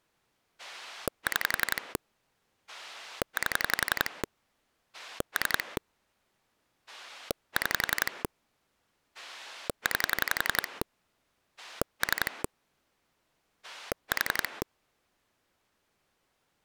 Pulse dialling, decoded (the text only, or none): 6 8 3 6 9 3 4